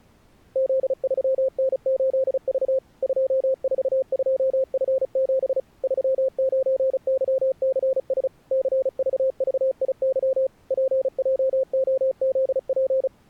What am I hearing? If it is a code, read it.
Morse code, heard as a keyed tone, machine-sent, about 35 wpm, 530 Hz. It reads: Z3N8V 242F7 39YCS CVVIY PJOZP